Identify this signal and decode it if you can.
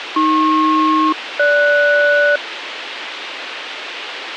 Aircraft SELCAL, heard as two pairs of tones, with radio hiss. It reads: AP-GS